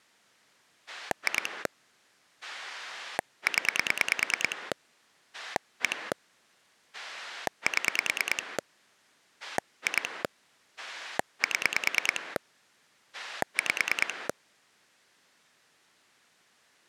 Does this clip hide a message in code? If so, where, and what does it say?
Yes: pulse dialling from 0.9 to 14.3 s, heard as a rotary dial, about 9 pulses a second. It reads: 2 0 1 7 2 7 5